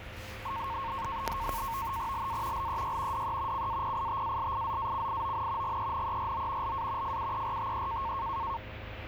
NAVTEX (SITOR-B), 100 baud, 170 Hz shift, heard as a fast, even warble, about 1000 Hz centre, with radio static and the noise inside a bus. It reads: LA LEY DE CAPITALIZACION GENERO LA FUERTE